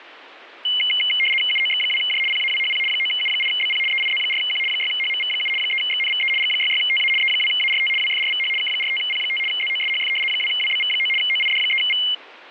RTTY (75 baud, 850 Hz shift), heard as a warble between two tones, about 2550 Hz centre. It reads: UOX2J PAWHP 9U8BP EIZ4Q 6HMV7 3XNVE G66TA E2ART WFRVH K45P5 ZOSHF 2WBV9 OID3V